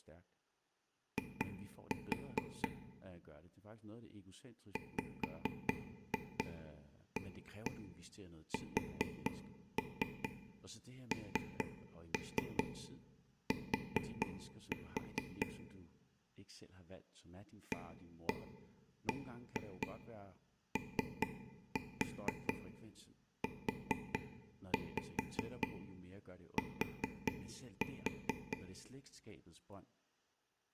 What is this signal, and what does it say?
Tap code, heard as taps on a table, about 4 knocks a second, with room echo and speech in Danish. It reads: I WASNT ABOUT